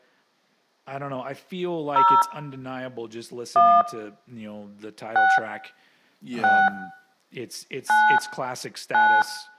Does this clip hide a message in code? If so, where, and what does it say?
Yes: DTMF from 2.0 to 9.2 s, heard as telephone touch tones, dialled by hand, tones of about 260 ms, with speech in English. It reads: 0 1 6 6 9 9